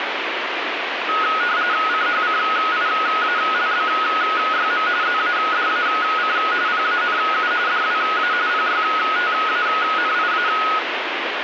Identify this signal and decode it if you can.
RTTY (45.45 baud, 170 Hz shift), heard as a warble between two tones, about 1360 Hz centre, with radio static. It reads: CHCIALBYM ZADAC PANU DWA PYTANIA